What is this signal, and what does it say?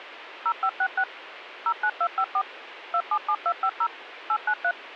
DTMF, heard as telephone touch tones, dialled by machine, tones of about 70 ms, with radio hiss. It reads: 0566 09254 277250 893